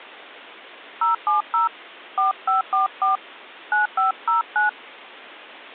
DTMF, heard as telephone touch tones, dialled by hand, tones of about 140 ms. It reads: 070 4544 9509